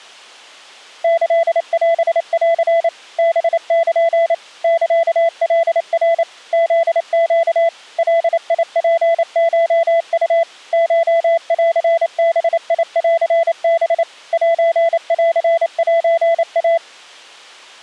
Morse code (Japanese Wabun code), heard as a keyed tone, machine-sent, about 28 wpm, 670 Hz. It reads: キオン ハル サカナ フネ ガツコウ コンバンハ センセイ